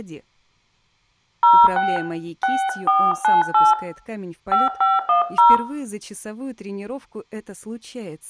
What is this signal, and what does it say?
DTMF, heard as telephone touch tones, dialled by hand, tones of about 200 ms, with room echo. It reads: 06 6498 5510